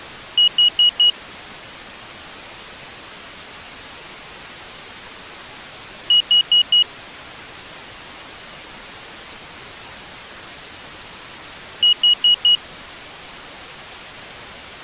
Alarm pattern, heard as an alarm's beeps, played three times, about 2900 Hz. Temporal four. Carbon monoxide.